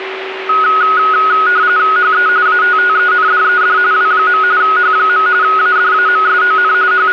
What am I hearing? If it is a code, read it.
RTTY (45.45 baud, 170 Hz shift), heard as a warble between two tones, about 1360 Hz centre, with radio static and a steady whistle near 380 Hz. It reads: HE ATTENDED W. H. ADAMSON …